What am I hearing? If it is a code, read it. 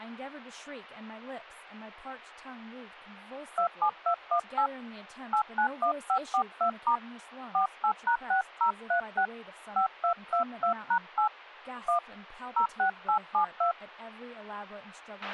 DTMF, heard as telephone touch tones, dialled by hand, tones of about 100 ms, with a squelch burst at the end and speech in English. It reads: 27218 891542* 48#6036 5222#8 1 06872